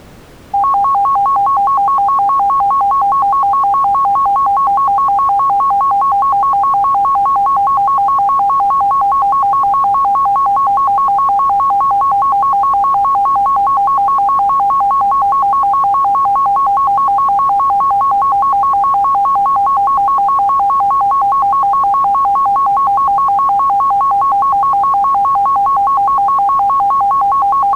A tone that alternates evenly between two pitches. There is no code.